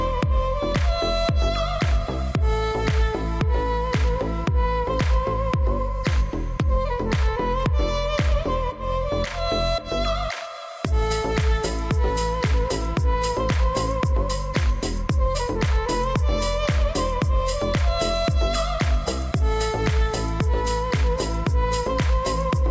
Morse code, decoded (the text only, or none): none